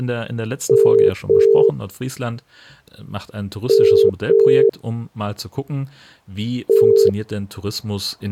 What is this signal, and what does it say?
Telephone call progress tone (as in the UK, Ireland, Australia and similar networks), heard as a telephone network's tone, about 400, 450 Hz, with speech in German. Ringback tone.